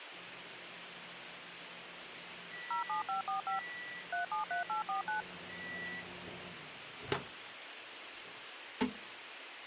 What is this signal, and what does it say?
DTMF, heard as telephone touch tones, dialled by machine, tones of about 120 ms, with radio hiss and kitchen noise. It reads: 07545 373849